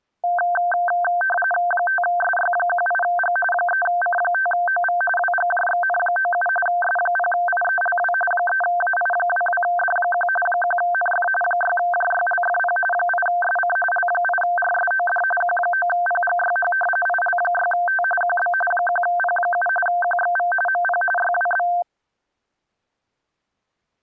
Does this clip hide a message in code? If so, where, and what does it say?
Yes: RTTY (45.45 baud, 850 Hz shift) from 0.2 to 21.8 s, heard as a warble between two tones, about 1130 Hz centre. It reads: 5SY18G 3C5OV WGJXN97 S0IELW 3AI22D1 1NF 6JYLFP 8SC L8RSOD Q9PGYH IL6T QB 1P7 QXV MP YWB